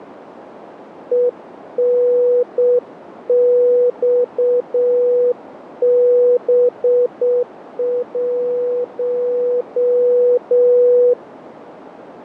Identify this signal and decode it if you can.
Morse code, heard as a keyed tone, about 7 wpm, 490 Hz, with radio static and a narrow filter. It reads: ENXB1